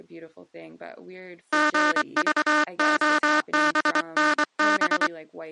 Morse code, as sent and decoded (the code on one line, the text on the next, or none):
--. ...- --- -... -. -...
GVOBNB